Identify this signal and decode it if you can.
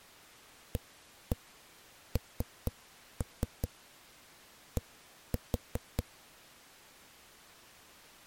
Tap code, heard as knocks on a wall, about 4 knocks a second. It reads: AND